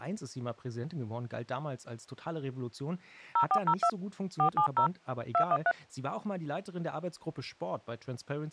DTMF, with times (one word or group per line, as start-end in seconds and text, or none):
3.4-3.9 0402
4.4-4.9 470
5.3-5.7 213